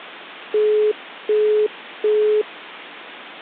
Telephone call progress tone (as in the UK, Australia and similar networks), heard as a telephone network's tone, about 420 Hz, 0.375 s on and 0.375 s off. Busy tone.